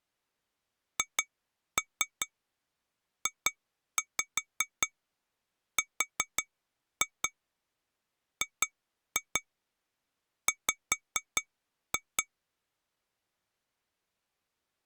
Tap code, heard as taps on glass, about 5 knocks a second. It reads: HJRGW